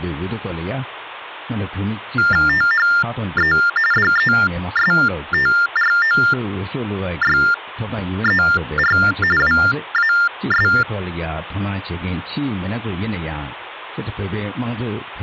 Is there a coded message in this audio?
Yes: TTY/TDD text telephone tones (45.45 baud Baudot) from 2.2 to 10.8 s, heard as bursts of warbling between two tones, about 400 Hz shift, 1600 Hz centre. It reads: THE DESTROYER WAS